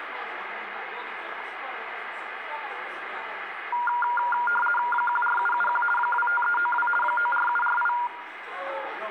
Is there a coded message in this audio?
Yes: RTTY (50 baud, 450 Hz shift) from 3.7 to 8.1 s, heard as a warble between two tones, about 1190 Hz centre, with the noise of a crowd indoors. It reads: 14771 25392 94748